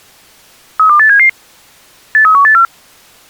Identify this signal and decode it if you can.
Five-tone selective call (CCIR), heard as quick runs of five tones, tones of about 100 ms. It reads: 32877 83184